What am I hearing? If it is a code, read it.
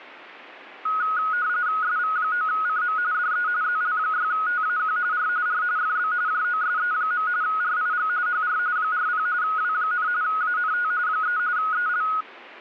RTTY (45.45 baud, 170 Hz shift), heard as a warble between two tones, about 1360 Hz centre. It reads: SV9CM DE ZL6TAQ R R FB JOSE. RIG HR 40 W, ANT 3 EL